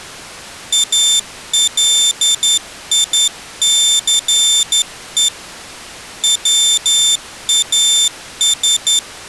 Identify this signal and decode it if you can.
Morse code, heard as a high beeper, hand-sent with a straight key, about 11 wpm, 3550 Hz. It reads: ALICE WAS